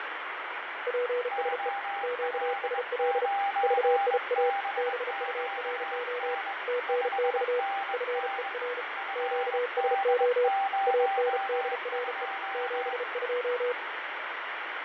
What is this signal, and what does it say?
Morse code, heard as two keyed tones, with radio static and fading. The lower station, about 34 wpm, 490 Hz: PSE QSL VIA BURO TNX FER QSO ANDRE 72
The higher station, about 22 wpm, 790 Hz: OL9BQN 5NN FD02